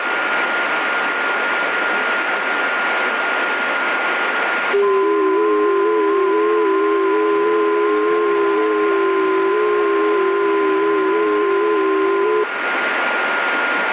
FT8 (several signals at once), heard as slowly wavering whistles, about 6.25 baud, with radio static, a steady whistle near 1420 Hz and speech in English.